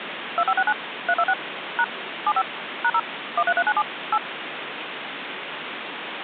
DTMF, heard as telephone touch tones, dialled by machine, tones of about 60 ms, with phone line noise. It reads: 2569 326 # 75 #0 13397 8